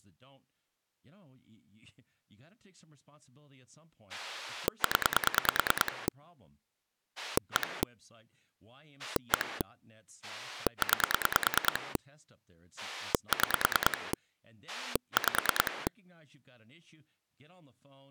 Pulse dialling, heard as a rotary dial, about 9 pulses a second, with speech in English. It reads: 0 1 1 9 6 5